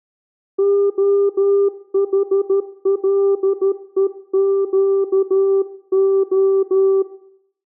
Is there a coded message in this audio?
Yes: Morse code (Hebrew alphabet) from 0.5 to 7.1 s, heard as a keyed tone, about 13 wpm, 390 Hz, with room echo. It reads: החלוקה